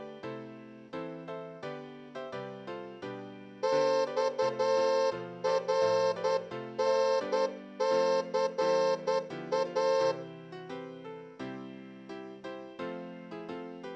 Morse code (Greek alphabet), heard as a horn, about 10 wpm, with room echo. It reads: ΞΡΝΘΑ